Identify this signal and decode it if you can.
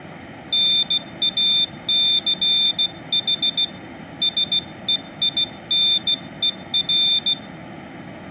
Morse code, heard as a high beeper, hand-sent with a bug key, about 16 wpm, 3600 Hz. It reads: NACH SEINER